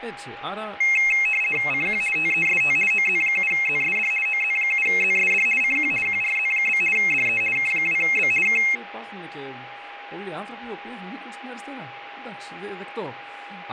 RTTY (50 baud, 450 Hz shift), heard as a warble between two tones, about 2350 Hz centre, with radio static, a steady whistle near 810 Hz and speech in Greek. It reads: CQ TEST OZ7ZSD OZ7ZSD CQ QRZ? DE K2B K